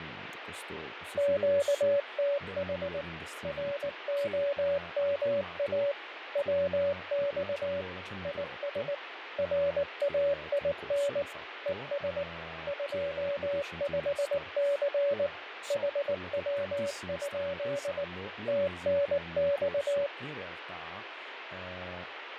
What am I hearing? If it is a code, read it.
Morse code, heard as a keyed tone, machine-sent, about 19 wpm, 570 Hz, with radio static, fading and speech in Italian. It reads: QTH ROMA WX IS RAIN ES 25C HW? TNX